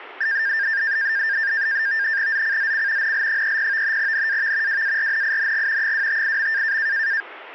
NAVTEX (SITOR-B), 100 baud, 170 Hz shift, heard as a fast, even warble, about 1700 Hz centre. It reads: ZCZC NL30 NAV WARNING 258.